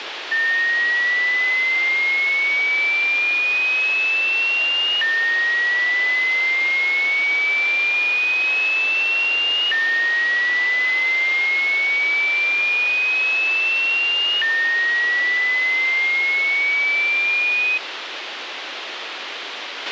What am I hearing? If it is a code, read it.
A tone that sweeps in pitch again and again, with radio hiss and a squelch burst at the end. There is no code.